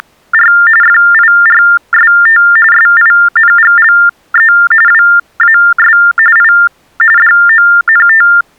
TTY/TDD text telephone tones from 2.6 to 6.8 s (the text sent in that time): SINGLE WAS I